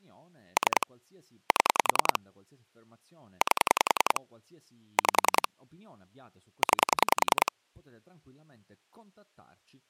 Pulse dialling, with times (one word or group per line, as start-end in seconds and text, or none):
0.6-0.9 3
1.5-2.2 7
3.4-4.2 8
5.0-5.5 5
6.6-7.5 9